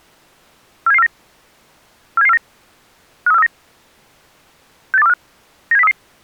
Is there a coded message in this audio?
Yes: five-tone selective call (EEA) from 0.9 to 5.9 s, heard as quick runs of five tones, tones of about 40 ms. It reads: 47749 47749 53439 68245 97033